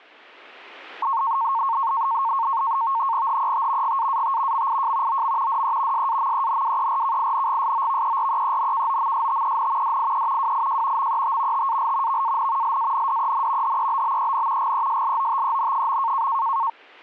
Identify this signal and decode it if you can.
NAVTEX (SITOR-B), 100 baud, 170 Hz shift, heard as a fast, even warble, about 1000 Hz centre. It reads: HET GAAT MIJ OM DE SAMENWERKINGSOVEREENKOMSTEN DIE WIJ MET TAL VAN LANDEN HEBBEN GESLOTEN.